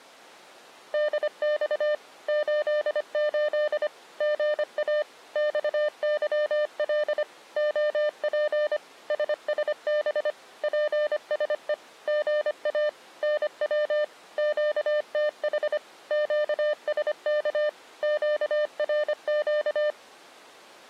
Morse code, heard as a keyed tone, machine-sent, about 25 wpm, 600 Hz. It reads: DX 88 GA XYL OP SSB PSE GA NW QTH QSK QRQ